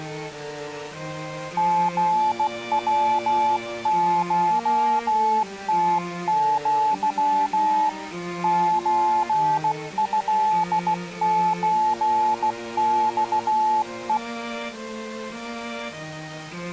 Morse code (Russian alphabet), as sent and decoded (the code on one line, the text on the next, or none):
--. .-- ---- - --.-- / ---. ..-.. ---. -..- .
ГВШТЪ ЧЭЧЬЕ